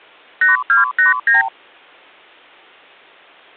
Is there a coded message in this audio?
Yes: multi-frequency trunk signalling (R2, with the far end's replies) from 0.4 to 1.5 s, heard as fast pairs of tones, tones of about 140 ms. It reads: 8289